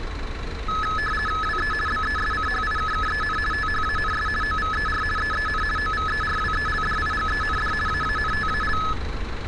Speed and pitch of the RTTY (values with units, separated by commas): 50 baud, 450 Hz shift, 1500 Hz centre